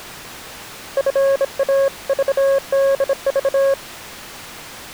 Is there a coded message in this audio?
Yes: Morse code (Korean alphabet) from 0.9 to 3.8 s, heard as a keyed tone, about 26 wpm, 550 Hz. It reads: 노를